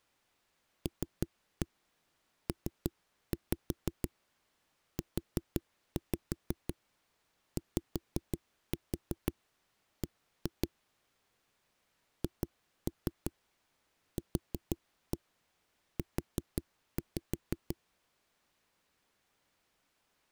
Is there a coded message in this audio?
Yes: tap code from 0.9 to 17.8 s, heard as knocks on a wall, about 5 knocks a second. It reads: LPUYB HQU